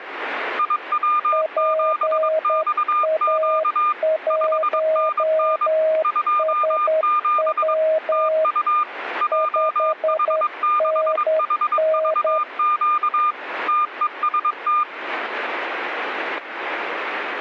Morse code, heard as two keyed tones, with radio static and static crashes. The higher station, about 22 wpm, 1210 Hz: IW7XQ 5NN 27 TU JH6HVQ TEST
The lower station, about 10 wpm, 630 Hz: PA1SW 5NN